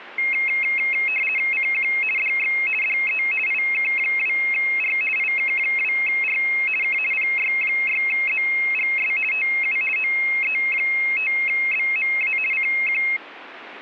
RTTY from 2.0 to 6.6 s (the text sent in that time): DX DE IK2R IK2R